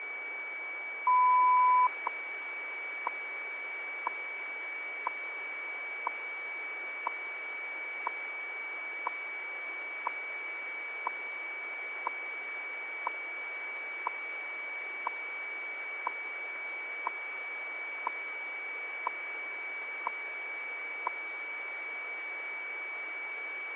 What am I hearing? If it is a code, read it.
Radio time signal (WWV, Colorado), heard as ticks, one a second, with a steady whistle near 2280 Hz.